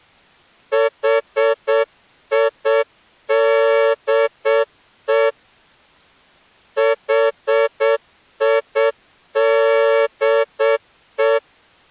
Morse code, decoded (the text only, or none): HIDE HIDE